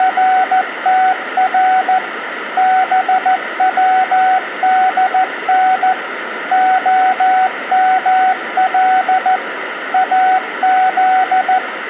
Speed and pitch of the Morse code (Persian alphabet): 14 wpm, 750 Hz

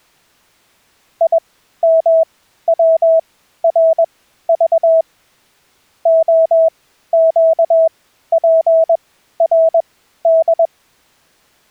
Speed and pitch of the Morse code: 21 wpm, spaced as for 13 wpm, 650 Hz

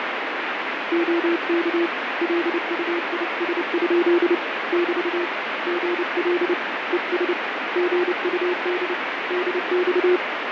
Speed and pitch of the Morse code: 29 wpm, 350 Hz

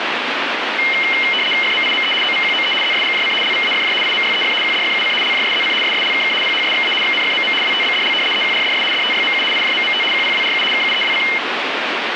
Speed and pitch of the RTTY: 75 baud, 850 Hz shift, 2550 Hz centre

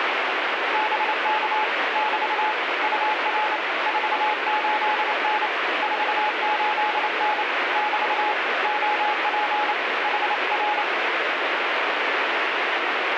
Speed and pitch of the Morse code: 28 wpm, 850 Hz

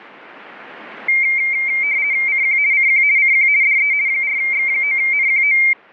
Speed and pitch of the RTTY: 50 baud, 170 Hz shift, 2200 Hz centre

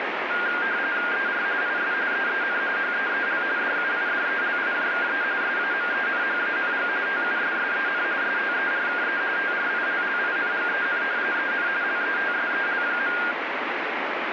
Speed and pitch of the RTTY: 45.45 baud, 170 Hz shift, 1500 Hz centre

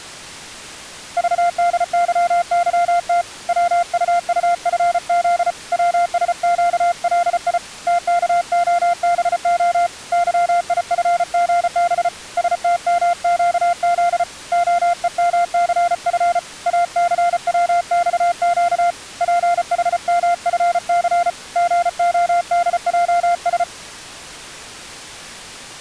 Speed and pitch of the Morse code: 34 wpm, 700 Hz

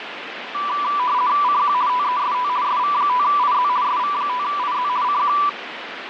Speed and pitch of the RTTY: 50 baud, 170 Hz shift, 1080 Hz centre

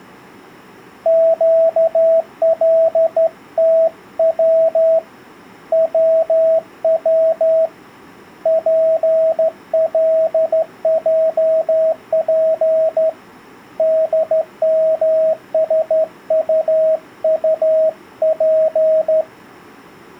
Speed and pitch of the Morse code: 13 wpm, 640 Hz

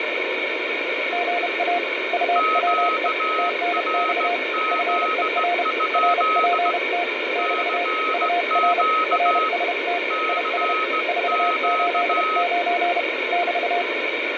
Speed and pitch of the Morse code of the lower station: 31 wpm, 700 Hz

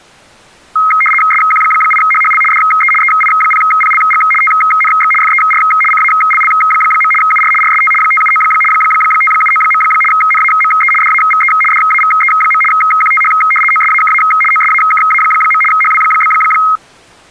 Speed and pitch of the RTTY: 75 baud, 850 Hz shift, 1700 Hz centre

